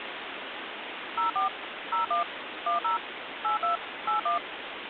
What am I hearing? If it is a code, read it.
DTMF, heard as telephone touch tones, dialled by machine, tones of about 130 ms, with phone line noise. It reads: 04 01 10 82 81